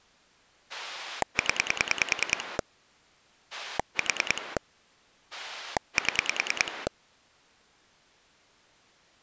Pulse dialling, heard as a rotary dial, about 10 pulses a second. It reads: 0 4 7